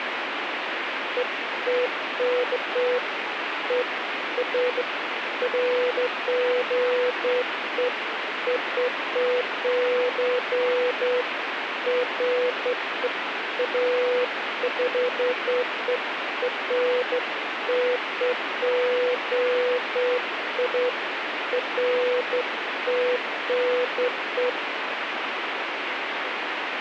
Beeps of irregular length, with radio hiss. There is no code.